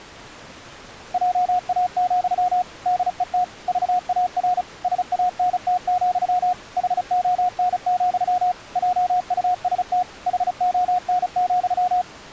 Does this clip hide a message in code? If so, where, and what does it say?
Yes: Morse code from 1.1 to 12.1 s, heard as a keyed tone, machine-sent, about 35 wpm, 720 Hz. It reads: JA, DET VAR SANT, HON, JUST HON,